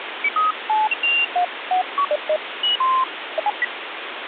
Electronic bleeps of random pitch and length, with phone line noise. There is no code.